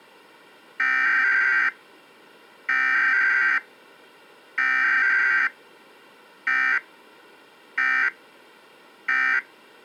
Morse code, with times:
none

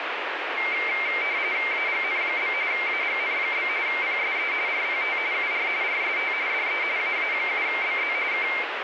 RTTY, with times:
1.7-2.5 AGN?
2.7-3.7 AGN?
3.9-4.5 PSE
4.7-5.2 RPT
5.3-5.7 UR
5.8-6.3 RST
6.5-6.8 DE
7.0-8.1 AA7BZ
8.3-8.5 K

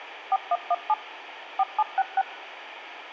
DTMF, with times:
0.3-0.9 4117
1.6-2.2 4766

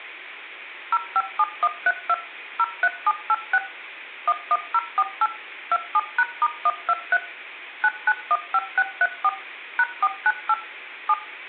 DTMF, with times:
0.9-2.1 057132
2.6-3.6 03786
4.3-5.3 11048
5.7-7.2 27#*123
7.8-9.3 9915634
9.8-10.5 #498
11.1-11.1 7

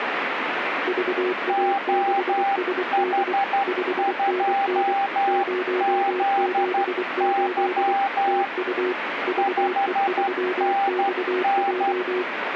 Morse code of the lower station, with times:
0.9-3.3 VA6SD
3.7-4.9 5NN
5.3-7.9 078
8.3-8.9 TU
9.3-12.2 VE3XJ

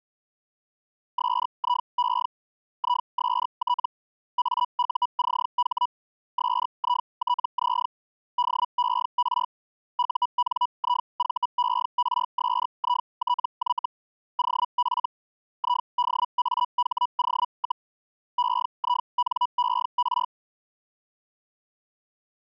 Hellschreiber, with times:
1.2-2.3 SIE
2.8-3.9 IST
4.4-5.9 AUCH
6.4-7.9 SITZ
8.4-9.5 DER
10.0-13.9 UNIVERSITY
14.4-15.1 OF
15.6-17.9 IDAHO,
18.4-20.3 EINER

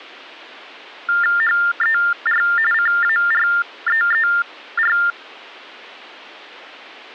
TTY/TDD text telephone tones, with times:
1.4-2.4 HER
2.7-5.0 CAREER

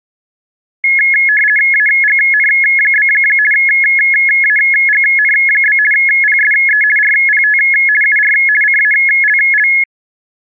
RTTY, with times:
1.7-3.1 AGN?
3.5-5.8 AGN?
5.9-6.8 PSE
7.0-7.6 RPT
8.0-8.3 UR
8.6-9.7 CALL

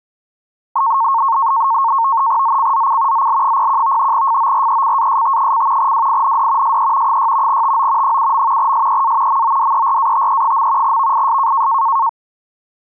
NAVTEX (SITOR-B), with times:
2.4-3.3 ZCZC
3.1-4.1 ZL01
4.1-5.9 FORECAST:
5.8-6.8 WIND
6.6-7.2 SE
7.1-7.6 6
7.5-8.2 TO
8.0-8.7 7.
8.6-9.4 SEA
9.3-11.0 MODERATE.
10.8-11.7 VIS

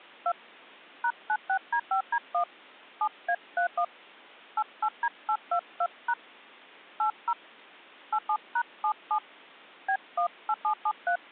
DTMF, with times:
0.3-0.3 2
1.0-2.4 #96D5D1
3.0-3.8 7A31
4.6-6.1 88D822#
7.0-7.3 80
8.1-9.2 87#77
9.9-11.2 B18773

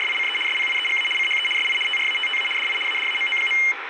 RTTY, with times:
0.0-0.4 …
0.5-1.1 SPIEGA
1.2-1.5 CHE
1.6-1.8 SI
1.9-2.5 TRATTA
2.6-2.8 DI
2.9-3.6 ADAMO.

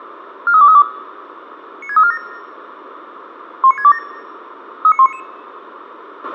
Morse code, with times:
none

